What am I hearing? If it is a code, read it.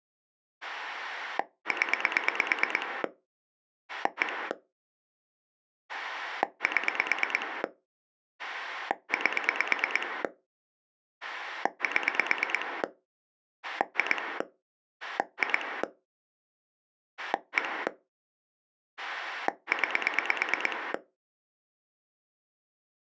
Pulse dialling, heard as a rotary dial, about 9 pulses a second. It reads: 0 1 7 8 7 2 2 1 9